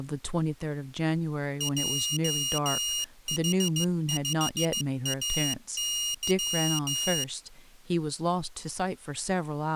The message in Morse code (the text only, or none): JH5AY